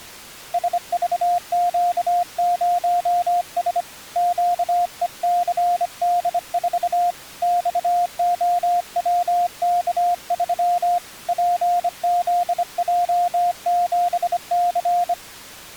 Morse code, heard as a keyed tone, hand-sent with a bug key, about 25 wpm, 700 Hz. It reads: SVQ0S QECD4 XOWK3 PZJ7C